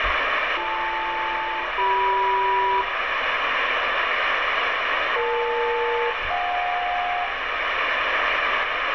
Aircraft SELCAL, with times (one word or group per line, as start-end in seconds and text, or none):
0.6-2.8 BL-CM
5.2-7.2 EL-JK